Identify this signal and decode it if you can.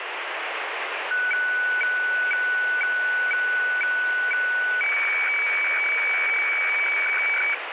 Weather fax (radiofax), 120 lines a minute, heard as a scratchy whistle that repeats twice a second, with radio static.